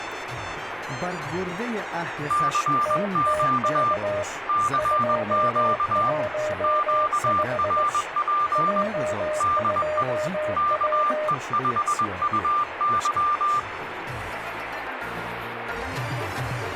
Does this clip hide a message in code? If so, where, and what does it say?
Yes: Morse code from 2.2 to 13.7 s, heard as two keyed tones, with radio static. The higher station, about 21 wpm, 1190 Hz: CQ CQ QRP DE KE5UY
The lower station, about 19 wpm, 610 Hz: TTK 215 J2W